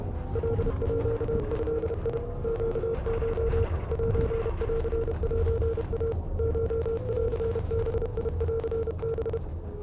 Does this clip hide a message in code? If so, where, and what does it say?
Yes: Morse code (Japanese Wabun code) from 0.3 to 9.4 s, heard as a keyed tone, machine-sent, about 31 wpm, 460 Hz, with the noise inside a bus. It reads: カード ネコ センセイ コンバンハ